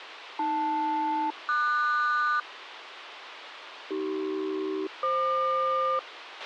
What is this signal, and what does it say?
Aircraft SELCAL, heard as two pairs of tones, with radio hiss and a squelch burst at the end. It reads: AL-QS AC-FQ